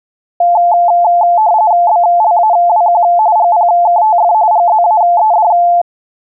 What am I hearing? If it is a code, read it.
RTTY (45.45 baud, 170 Hz shift), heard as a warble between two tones, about 780 Hz centre. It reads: BLAWQ GPKTF GZAED